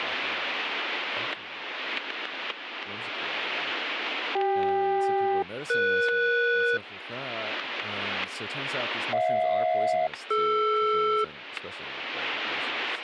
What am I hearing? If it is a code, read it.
Aircraft SELCAL, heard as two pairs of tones, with static crashes and speech in English. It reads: CK-ES HJ-DR